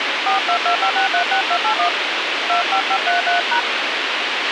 DTMF, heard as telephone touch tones, dialled by hand, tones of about 100 ms, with radio hiss and a squelch burst at the end. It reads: 4225636281 25533#